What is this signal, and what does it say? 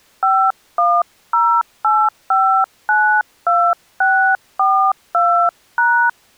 DTMF, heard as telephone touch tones, dialled by hand, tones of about 300 ms. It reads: 5108592642#